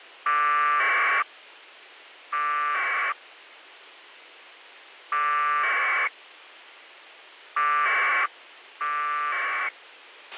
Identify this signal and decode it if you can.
Packet radio (AX.25, as in APRS), 1200 baud, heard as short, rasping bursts, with a squelch burst at the end.